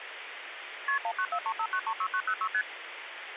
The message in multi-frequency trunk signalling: KP 19435936906 ST

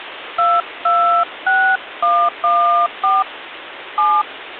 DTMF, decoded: 226114 7

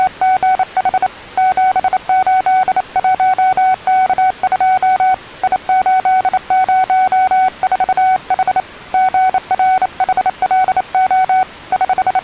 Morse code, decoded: … 781K2 I804H GRHLO …

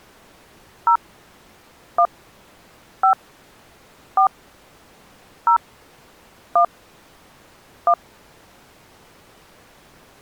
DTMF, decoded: 0 1 5 4 0 1 1

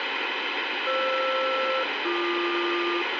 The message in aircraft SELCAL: FR-BQ

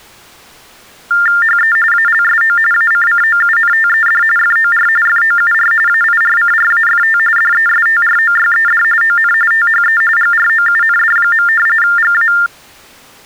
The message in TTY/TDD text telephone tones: HE ALSO ACCOUNTED FOR FOUR AIRCRAFT DESTROYED ON THE GROUND. GA

